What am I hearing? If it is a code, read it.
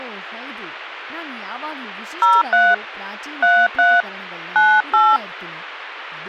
DTMF, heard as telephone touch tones, dialled by hand, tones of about 240 ms, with speech in Kannada. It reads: 03 33 98